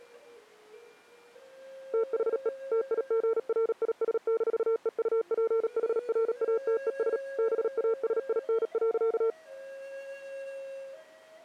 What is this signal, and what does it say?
Morse code, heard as a keyed tone, machine-sent, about 37 wpm, 450 Hz. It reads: THE TIGRIS-EUPHRATES BASIN.